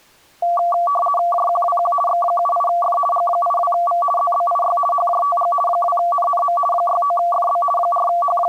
RTTY (50 baud, 450 Hz shift), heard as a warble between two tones, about 920 Hz centre. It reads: JQWQ X78F G82V ZBIY HJTG 2NNM 69FB …